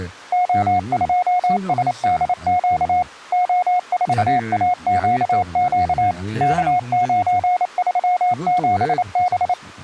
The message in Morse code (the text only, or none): O2SDQ O4AQQ K937B